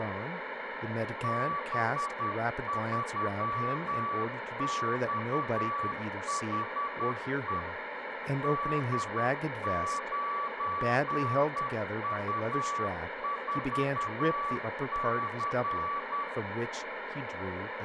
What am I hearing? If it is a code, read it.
Morse code, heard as a keyed tone, machine-sent, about 10 wpm, 1150 Hz, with radio static, room echo and speech in English. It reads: B3XHE D9U4C